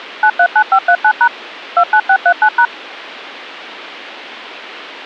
DTMF, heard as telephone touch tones, dialled by machine, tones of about 70 ms. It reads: 939539# 29639#